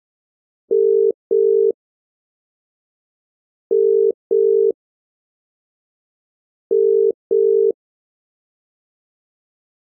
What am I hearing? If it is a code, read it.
Telephone call progress tone (as in the UK, Ireland, Australia and similar networks), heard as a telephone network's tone, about 400, 450 Hz. Ringback tone.